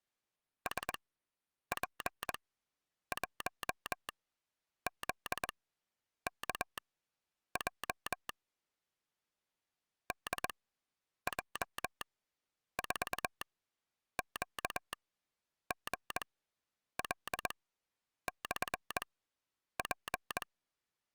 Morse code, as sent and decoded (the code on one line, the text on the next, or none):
... .--. .---- --.. -.- .--- / -.. .--- ....- --.- --. .-.. -..-. .--.
SP1ZKJ DJ4QGL/P